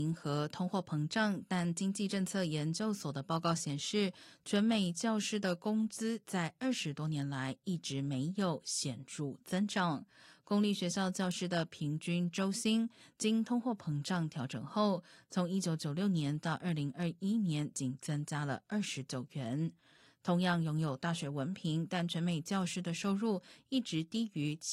Speech in Chinese. There is no code.